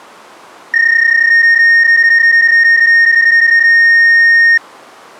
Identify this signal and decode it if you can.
PSK31 (31.25 baud), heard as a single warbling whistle, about 1850 Hz.